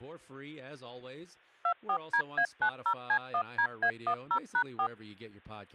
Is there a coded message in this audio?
Yes: DTMF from 1.6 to 4.9 s, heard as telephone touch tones, dialled by machine, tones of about 80 ms, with speech in English. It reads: 24DA90C1DA10#4